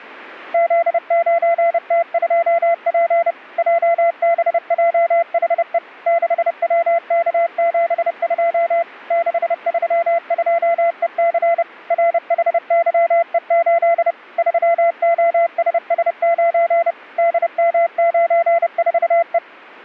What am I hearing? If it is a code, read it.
Morse code, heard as a keyed tone, machine-sent, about 30 wpm, 680 Hz. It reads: Z9T2P JBJHE 6WK72 632EC RHYE8 3OSS9 DM94E